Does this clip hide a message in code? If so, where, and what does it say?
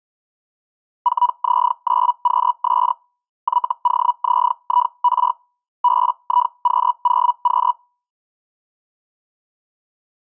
Yes: Hellschreiber (Feld-Hell, 122.5 baud) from 1.0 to 7.7 s, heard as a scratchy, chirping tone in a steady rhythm, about 980 Hz. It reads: 4Z9QS YOZIR BIQ0Q